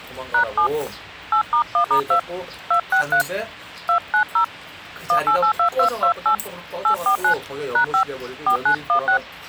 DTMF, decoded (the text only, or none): #7 8*1*2 263 290 1882228 849 #5 4916